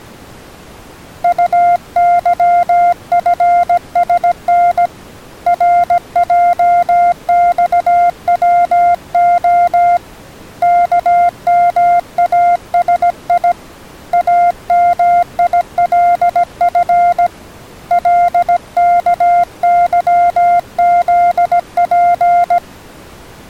Morse code, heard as a keyed tone, hand-sent with a paddle, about 17 wpm, 700 Hz. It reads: UYFSN RJXWO KMASI AMILF LKYZP